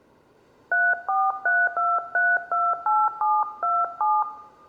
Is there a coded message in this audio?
Yes: DTMF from 0.7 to 4.2 s, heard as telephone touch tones, dialled by hand, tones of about 220 ms, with room echo. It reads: 3432328727